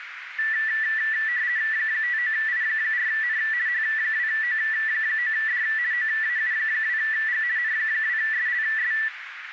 RTTY (50 baud, 170 Hz shift), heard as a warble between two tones, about 1850 Hz centre, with radio static and a narrow filter. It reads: 59I4N H2O9D OAU2G N2SLS